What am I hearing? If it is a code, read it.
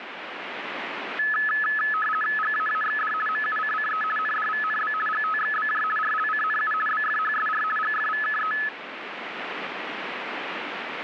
RTTY (50 baud, 450 Hz shift), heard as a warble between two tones, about 1500 Hz centre, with radio static. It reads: GAAXD MUCCE NDVNB GTXBJ RLCNU BFHSR GFVKE